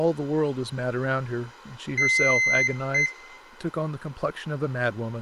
Beep code, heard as a piezo beeper, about 2050 Hz, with room echo and speech in English. 1 long, 1 short. In IBM BIOS tables: system board problem.